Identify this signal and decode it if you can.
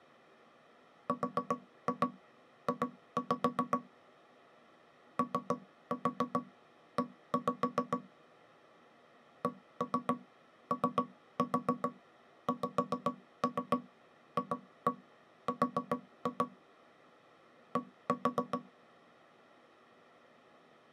Tap code, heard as knocks on wood, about 7 knocks a second. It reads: RJ OE COXFR D